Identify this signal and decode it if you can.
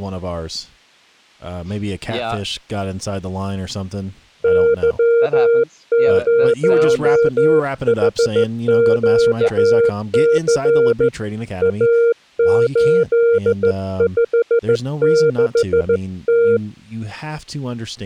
Morse code, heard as a keyed tone, hand-sent with a straight key, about 15 wpm, 470 Hz, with speech in English. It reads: Y0HQC A856T